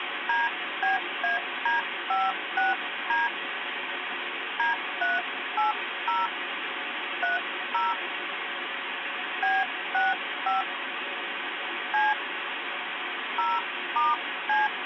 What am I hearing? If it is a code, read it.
DTMF, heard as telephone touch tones, dialled by hand, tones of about 170 ms, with phone line noise. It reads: DBAD56D D380 30 B65 C 0*C